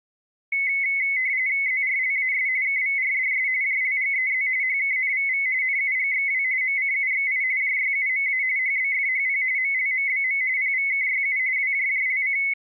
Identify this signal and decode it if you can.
RTTY (45.45 baud, 170 Hz shift), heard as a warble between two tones, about 2100 Hz centre. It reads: ZRLAS KVRDS JLGEZ HKNVV NUGXW MCUXI JYUMA HBFHP MLMBM PVKYU WJJLC